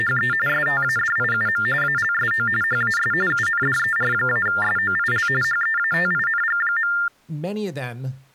TTY/TDD text telephone tones (45.45 baud Baudot), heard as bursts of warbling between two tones, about 400 Hz shift, 1600 Hz centre, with speech in English. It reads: … STADIUM ALSO HAS UNDER-SOIL HEATING.